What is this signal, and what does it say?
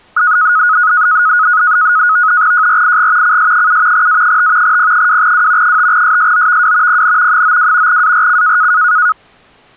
NAVTEX (SITOR-B), 100 baud, 170 Hz shift, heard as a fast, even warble, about 1360 Hz centre. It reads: JRIG CS7 A5 P2W 5SSOVW PN 92 ARC